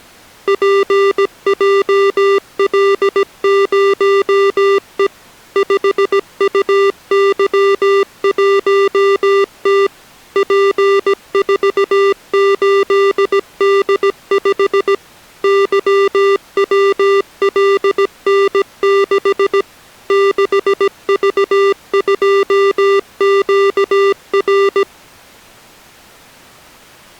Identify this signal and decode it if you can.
Morse code, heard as electronic beeps, machine-sent, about 17 wpm, 400 Hz. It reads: PJL0E 5UY1T P48D5 YWLN6 6V2QR